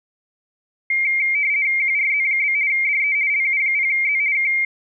RTTY (50 baud, 170 Hz shift), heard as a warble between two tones, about 2200 Hz centre. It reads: QRZ? DE LU0Z K